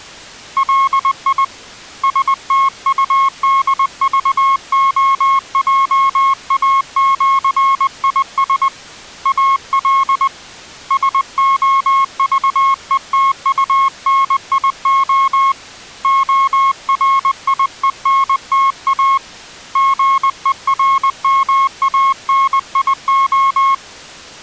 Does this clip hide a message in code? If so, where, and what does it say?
Yes: Morse code (with Esperanto letters) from 0.5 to 23.8 s, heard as a keyed tone, hand-sent with a paddle, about 20 wpm, 1090 Hz. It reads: LI STUDVOJAĜIS AL SOVETUNIO ORIENTA GERMANIO